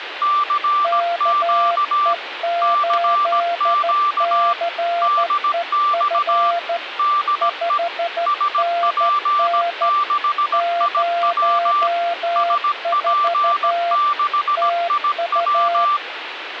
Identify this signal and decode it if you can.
Morse code, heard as two keyed tones, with radio static. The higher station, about 17 wpm, 1180 Hz: CQ CQ DX DE SP6IW SP6IW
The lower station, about 13 wpm, 690 Hz: KE8CEF 5NN 04 TU